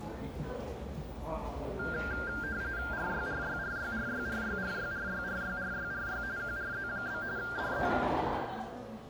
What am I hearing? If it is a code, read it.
RTTY (45.45 baud, 170 Hz shift), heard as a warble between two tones, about 1500 Hz centre, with the noise of a cafe. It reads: RYRYRYRYRYRYRYRYRYRY QRZ? DE